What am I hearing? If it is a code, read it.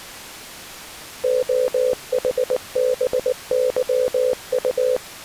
Morse code, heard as a keyed tone, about 19 wpm, 500 Hz. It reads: OHBYU